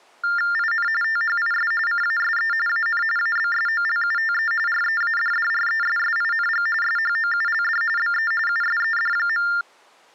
TTY/TDD text telephone tones (45.45 baud Baudot), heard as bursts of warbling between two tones, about 400 Hz shift, 1600 Hz centre. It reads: IN THIS CASE AN ABSOLUTE READDRESSING SHOULD BE USED.